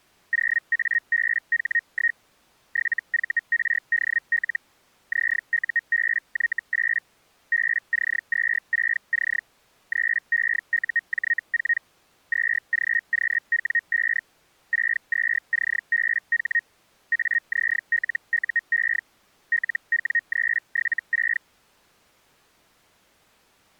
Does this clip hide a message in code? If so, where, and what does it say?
Yes: Hellschreiber (Feld-Hell, 122.5 baud) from 0.3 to 21.4 s, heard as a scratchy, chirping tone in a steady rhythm, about 1850 Hz. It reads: 0ABH1 7VRDL ZUBY8 BC26C 3EUJ4 2GQW5 62CBH AZLUE LW376